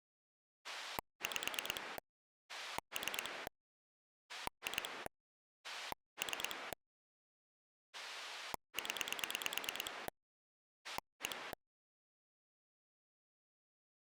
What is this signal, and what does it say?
Pulse dialling, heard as a rotary dial, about 9 pulses a second. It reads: 5 3 2 3 0 1